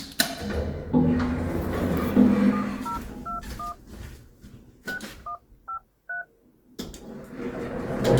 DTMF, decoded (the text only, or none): 7021 6153